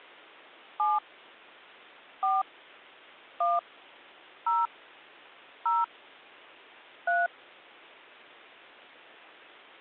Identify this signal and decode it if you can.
DTMF, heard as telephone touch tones, dialled by hand, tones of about 190 ms. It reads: 7 4 1 0 0 3